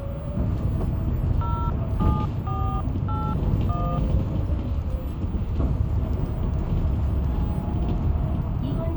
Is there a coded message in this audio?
Yes: DTMF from 1.4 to 4.0 s, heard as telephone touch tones, dialled by hand, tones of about 260 ms, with the noise inside a bus. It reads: 07481